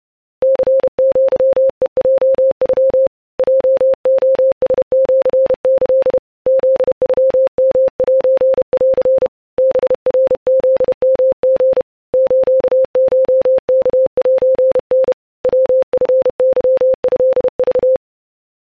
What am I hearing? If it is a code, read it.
Morse code (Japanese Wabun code), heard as a keyed tone, hand-sent with a paddle, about 31 wpm, 530 Hz. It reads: ニアヘヲノ ヲレラシキ フノヨセン ハナフヨリ スコワセタ ヤチケトク